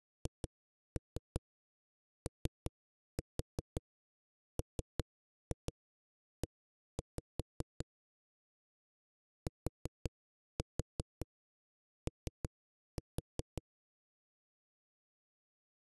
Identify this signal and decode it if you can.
Tap code, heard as knocks on a wall, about 5 knocks a second. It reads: HOME TO